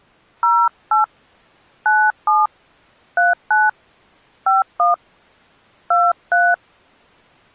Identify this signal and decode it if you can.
DTMF, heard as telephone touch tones, dialled by hand, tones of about 200 ms. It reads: 08 97 39 51 23